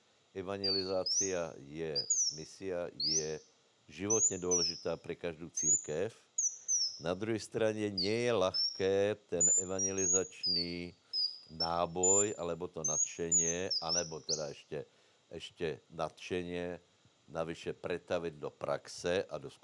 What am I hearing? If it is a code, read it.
Bird-like chirps, with room echo and speech in Slovak. There is no code.